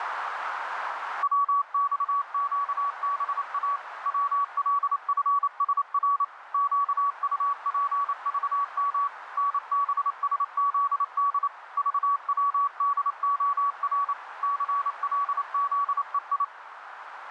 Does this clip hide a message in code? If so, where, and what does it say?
Yes: Morse code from 1.2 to 16.5 s, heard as a keyed tone, machine-sent, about 28 wpm, 1130 Hz, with radio static and a narrow filter. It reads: WXQBA WLFSR QUPVM NBSZD VWDOR CLZEI